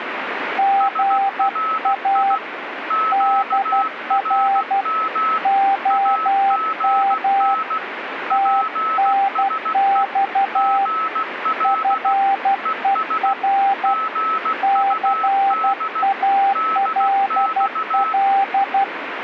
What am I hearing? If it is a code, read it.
Morse code, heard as two keyed tones, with radio static. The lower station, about 12 wpm, 790 Hz: GA DR OM TNX FER CALL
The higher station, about 16 wpm, 1300 Hz: SRI QRM AGN PSE GL ES GUD DX